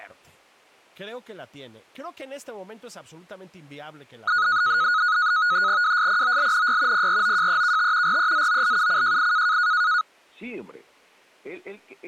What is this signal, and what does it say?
NAVTEX (SITOR-B), 100 baud, 170 Hz shift, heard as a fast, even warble, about 1360 Hz centre, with speech in Spanish. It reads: WSPOLNY PROJEKT REZOLUCJI